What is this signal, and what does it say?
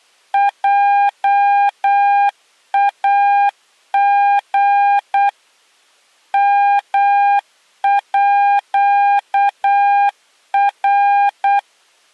Morse code (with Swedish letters), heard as a keyed tone, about 8 wpm, 810 Hz. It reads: JAG MÅR